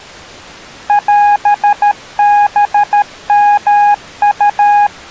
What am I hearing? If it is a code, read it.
Morse code (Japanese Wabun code), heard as a keyed tone, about 13 wpm, 820 Hz. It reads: オハヨウ